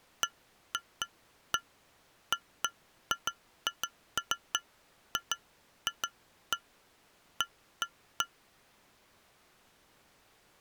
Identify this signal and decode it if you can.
Irregular taps on glass. There is no code.